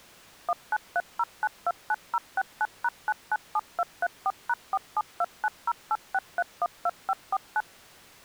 DTMF, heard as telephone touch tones, dialled by machine, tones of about 40 ms. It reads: 1930929069#997234#4729086312549